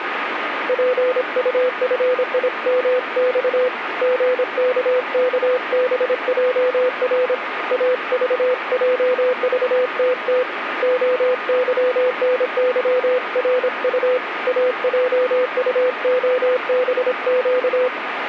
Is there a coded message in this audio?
Yes: Morse code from 0.6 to 17.9 s, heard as a keyed tone, hand-sent with a paddle, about 26 wpm, 500 Hz, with radio static. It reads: PUFIMX GKKBJR AVJVTT OYNYRU AJUOBQ